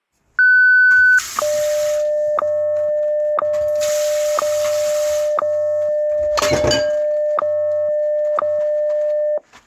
Radio time signal (WWVH, Hawaii), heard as ticks, one a second, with kitchen noise.